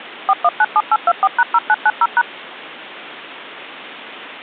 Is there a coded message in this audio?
Yes: DTMF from 0.3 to 2.2 s, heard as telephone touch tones, dialled by machine, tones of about 50 ms. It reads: 4197824#0990#